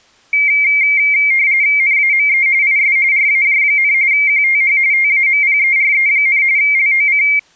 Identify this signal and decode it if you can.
RTTY (45.45 baud, 170 Hz shift), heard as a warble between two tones, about 2200 Hz centre. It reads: NAME IS RAJ, QTH TAMPERE, LOC